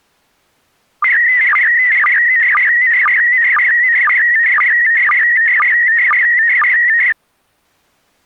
SSTV (slow-scan television), PD 120, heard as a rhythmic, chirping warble.